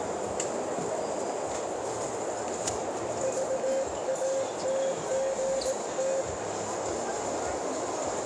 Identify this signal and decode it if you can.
Morse code, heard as a keyed tone, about 18 wpm, 540 Hz, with heavy radio static, a narrow filter and the noise of a crowd indoors. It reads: VATGT